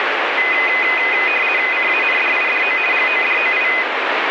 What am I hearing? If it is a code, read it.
RTTY (50 baud, 450 Hz shift), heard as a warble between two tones, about 2250 Hz centre, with radio static. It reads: CANDIDO GODOI